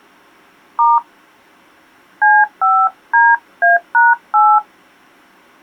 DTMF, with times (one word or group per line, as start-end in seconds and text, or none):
0.8-1.0 *
2.2-4.6 C5DA#8